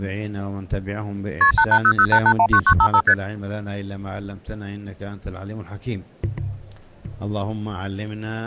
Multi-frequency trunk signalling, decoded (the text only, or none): KP 88008819955 ST